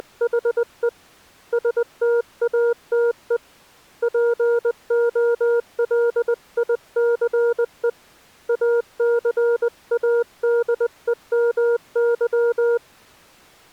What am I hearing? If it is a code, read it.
Morse code, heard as a keyed tone, hand-sent with a paddle, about 20 wpm, 470 Hz. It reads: … STATE POLICE ACADEMY